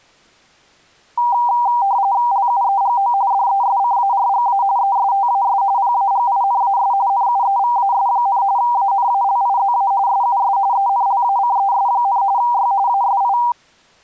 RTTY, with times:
2.3-3.1 LUEGO
3.3-4.6 DESCARGA
4.8-5.6 ESTAS
5.8-6.9 PAGINAS
7.1-8.4 NUEVAS,
8.6-9.9 ANALIZA
10.1-10.6 SUS
10.7-12.2 ENLACES,
12.4-12.7 Y
12.9-13.4 ASI

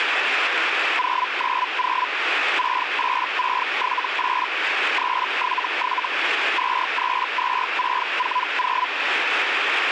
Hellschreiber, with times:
1.0-2.1 090
2.6-4.5 68678
5.0-6.1 377
6.6-8.9 232640

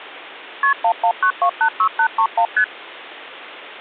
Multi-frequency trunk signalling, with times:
0.6-0.7 KP
0.8-2.5 119286831
2.6-2.6 ST

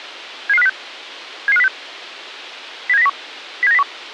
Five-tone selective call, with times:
0.5-0.7 77506
1.5-1.7 77506
2.9-3.1 07901
3.6-3.8 07901

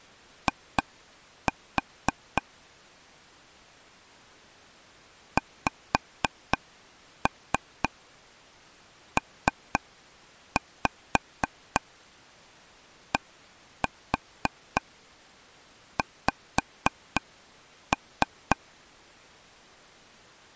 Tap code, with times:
0.5-2.4 I
5.4-18.6 XPDX

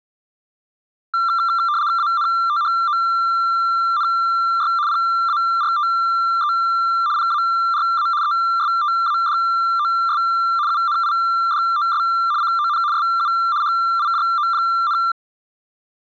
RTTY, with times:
2.0-4.7 ANTHONY
4.9-6.5 PARTE
7.2-8.1 PARA
8.2-10.2 ESTADOS
10.7-12.0 UNIDOS
12.4-12.8 CON
12.9-13.3 SU
13.6-15.0 HIJO,

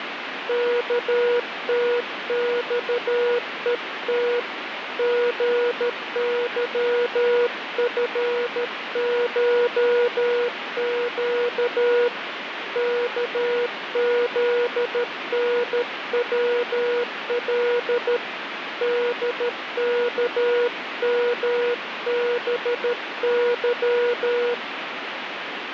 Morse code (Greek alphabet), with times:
0.5-4.4 ΚΤΞΕΤ
5.0-12.1 ΓΥΦΧΨ
12.8-18.2 ΚΖΝΩΛ
18.8-24.5 ΔΚΜΒΥ

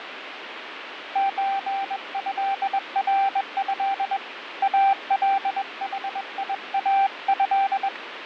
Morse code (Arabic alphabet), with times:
1.2-4.2 زهره
4.6-7.9 الحياه

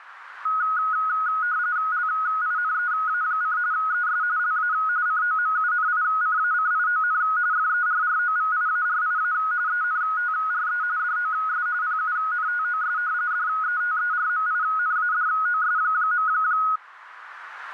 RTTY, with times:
1.9-3.6 LINEA:
3.7-4.2 ES
4.4-4.7 LA
5.1-7.2 COMUNICACION
7.5-9.3 FERROVIARIA
9.7-10.8 ENTRE
11.0-11.7 DOS
11.8-13.0 PUNTOS
13.3-16.3 DETERMINADOS.

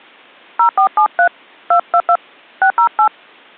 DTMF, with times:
0.6-1.3 0473
1.7-2.2 222
2.6-3.1 608

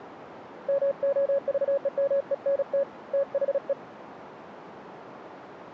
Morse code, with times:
0.7-2.8 MOVEMENT
3.1-3.7 THE

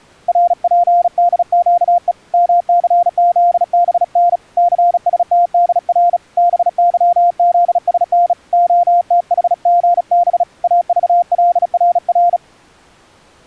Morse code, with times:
0.3-2.1 RPDQE
2.3-4.4 MCZBN
4.6-6.2 CSTDR
6.4-8.3 BYZSN
8.5-10.4 OTHGB
10.6-12.4 AVLRR

